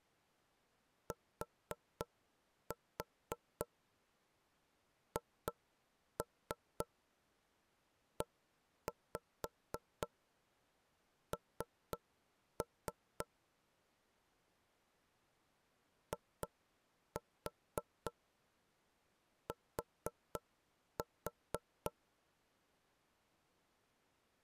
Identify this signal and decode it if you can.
Tap code, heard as knocks on wood, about 3 knocks a second. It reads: THEN IT